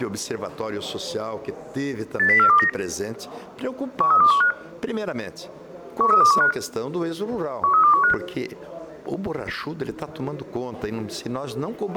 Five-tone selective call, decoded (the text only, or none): 80429 13215 13215 13215